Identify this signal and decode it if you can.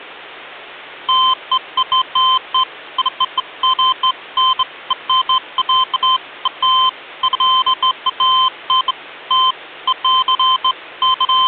Beeps of irregular length, with hum. There is no code.